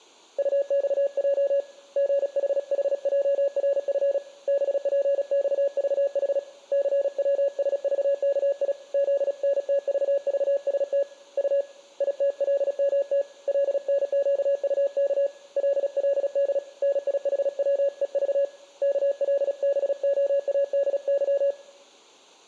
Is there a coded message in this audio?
Yes: Morse code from 0.3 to 21.6 s, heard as a keyed tone, hand-sent with a paddle, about 36 wpm, 560 Hz, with room echo. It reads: UXJ GHHJRF BPXVH CWSVKI ZNTVVST U ITLMT LNQUK LLD NIHWEV KLBOADY